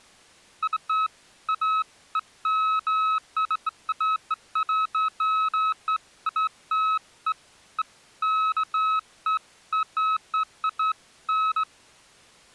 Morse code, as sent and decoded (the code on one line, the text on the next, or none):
none